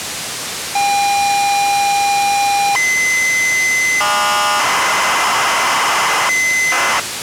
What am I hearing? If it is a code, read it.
ZX Spectrum tape loading, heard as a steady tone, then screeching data, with tape hiss.